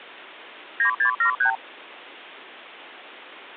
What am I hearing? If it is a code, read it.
Multi-frequency trunk signalling (R2, with the far end's replies), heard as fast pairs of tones, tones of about 100 ms. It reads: 9673